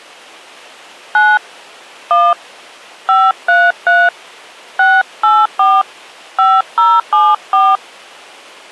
DTMF, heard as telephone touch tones, dialled by hand, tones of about 220 ms. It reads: 9 1 533 684 5074